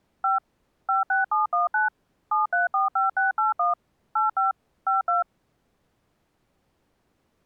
DTMF, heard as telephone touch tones, dialled by machine, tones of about 150 ms. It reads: 5 56719 7345681 85 52